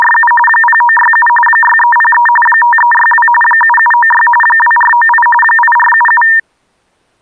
RTTY (45.45 baud, 850 Hz shift), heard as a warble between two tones, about 1380 Hz centre. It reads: … 0967 6303 5362 7796 2498 8477